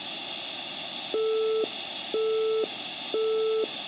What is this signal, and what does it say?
Telephone call progress tone (single-tone plan, as in Europe, Japan and elsewhere), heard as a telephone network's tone, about 440 Hz, 0.5 s on and 0.5 s off, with room echo. Busy tone.